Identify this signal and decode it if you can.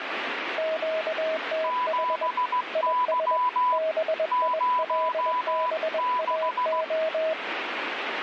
Morse code, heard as two keyed tones, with radio static. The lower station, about 21 wpm, 640 Hz: QTH IS BILBAO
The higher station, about 16 wpm, 1000 Hz: 7Y 06